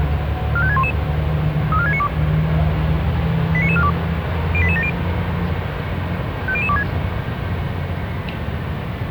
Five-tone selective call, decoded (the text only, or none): 45611 34692 89942 08870 50026